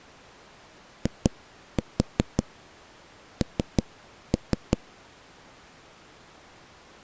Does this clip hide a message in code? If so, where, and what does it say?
Yes: tap code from 1.1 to 4.8 s, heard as knocks on a wall, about 5 knocks a second. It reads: IN